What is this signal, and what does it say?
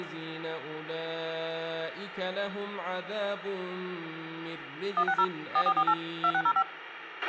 DTMF, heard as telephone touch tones, dialled by machine, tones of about 60 ms, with radio hiss and a squelch burst at the end. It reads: 160 4448 2605